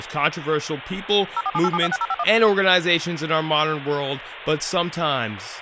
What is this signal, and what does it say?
DTMF, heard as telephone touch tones, dialled by machine, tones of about 40 ms, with phone line noise and speech in English. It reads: 0478726051